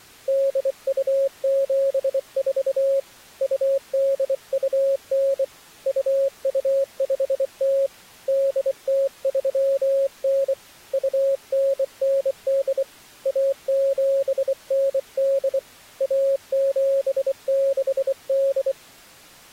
Morse code (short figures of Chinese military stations), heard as a keyed tone, hand-sent with a bug key, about 24 wpm, 550 Hz. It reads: 8274 2829 2250 8039 2998 1798 1768